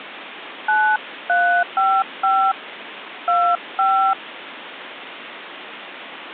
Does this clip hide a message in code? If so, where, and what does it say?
Yes: DTMF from 0.7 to 4.1 s, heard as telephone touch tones, dialled by hand, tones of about 270 ms, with phone line noise. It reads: 9355 25